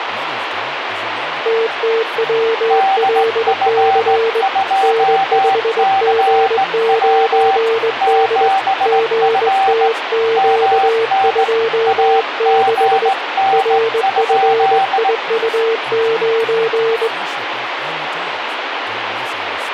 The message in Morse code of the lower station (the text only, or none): TTWLC N5G9D GTQ26 RFIU9